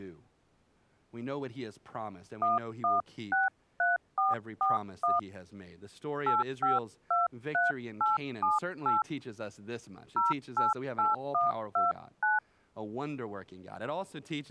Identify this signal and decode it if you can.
DTMF, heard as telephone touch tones, dialled by hand, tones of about 160 ms, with speech in English. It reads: 1163441 8523878 088129